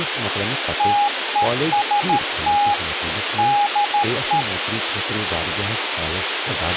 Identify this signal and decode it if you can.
Morse code, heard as a keyed tone, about 13 wpm, 820 Hz, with radio hiss, a squelch burst at the end and speech in Kashmiri. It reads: TEST DE